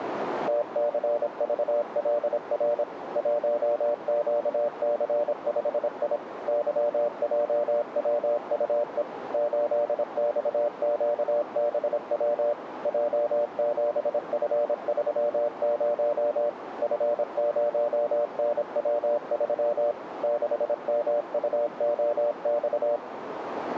Morse code, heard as a keyed tone, machine-sent, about 26 wpm, 590 Hz, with radio static and a narrow filter. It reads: TCVLR 1QC5I YJWUE 8XQBW J7F30 F0NW3 6MUOX